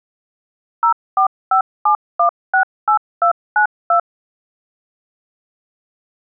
DTMF, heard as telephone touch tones, dialled by machine, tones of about 100 ms. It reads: 0457168292